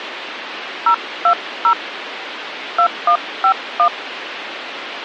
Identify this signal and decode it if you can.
DTMF, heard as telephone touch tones, dialled by hand, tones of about 80 ms, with phone line noise. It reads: 020 2151